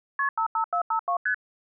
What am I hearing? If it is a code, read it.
Multi-frequency trunk signalling (R1, as on North American trunks), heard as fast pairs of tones, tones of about 90 ms. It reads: KP 55452 ST